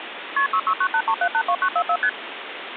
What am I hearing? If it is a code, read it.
Multi-frequency trunk signalling (R1, as on North American trunks), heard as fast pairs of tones, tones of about 70 ms, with phone line noise. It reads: KP 66983782944 ST